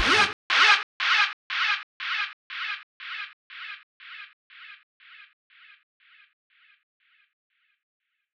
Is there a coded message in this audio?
No.